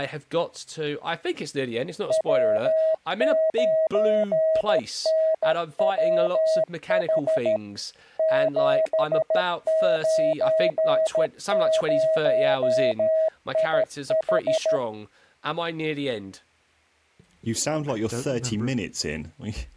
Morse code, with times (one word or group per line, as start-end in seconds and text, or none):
2.1-7.6 W9NWH
8.2-14.8 790IH